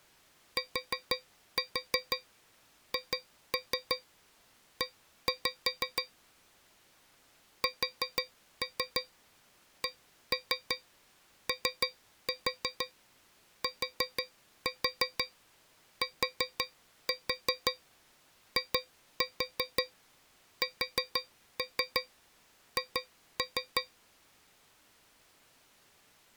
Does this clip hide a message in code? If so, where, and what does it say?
Yes: tap code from 0.6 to 23.9 s, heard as taps on a metal pipe, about 6 knocks a second. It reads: THE SCOTTISH